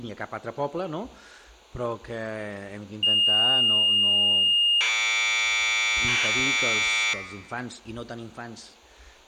Commodore tape loading (standard loader), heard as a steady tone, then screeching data, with room echo.